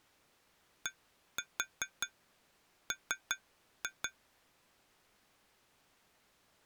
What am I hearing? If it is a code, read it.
Tap code, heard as taps on glass, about 5 knocks a second. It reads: DM